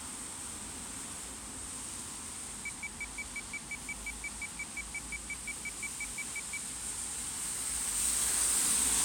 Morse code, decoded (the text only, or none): none